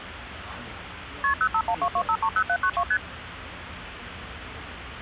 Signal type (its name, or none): multi-frequency trunk signalling